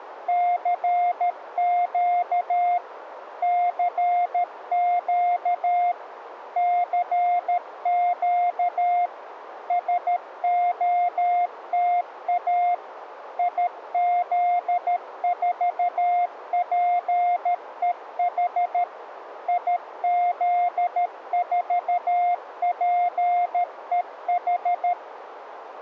Morse code, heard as a keyed tone, machine-sent, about 13 wpm, 710 Hz, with radio static. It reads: CQ CQ CQ SOTA IZ4PEH IZ4PEH